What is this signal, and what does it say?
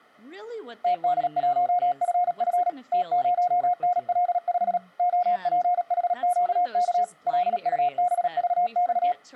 Morse code, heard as a keyed tone, machine-sent, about 37 wpm, 720 Hz, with speech in English. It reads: TD1FF T0NL5 OPHQK LUBVX